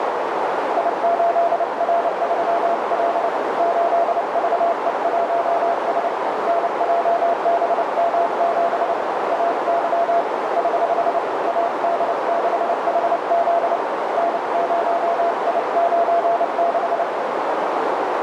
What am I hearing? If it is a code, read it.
Morse code, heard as a keyed tone, hand-sent with a paddle, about 29 wpm, 680 Hz, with heavy radio static and a narrow filter. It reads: I8R3L 8VE1S NJBM7 AY <HH> AD6HZ N0I96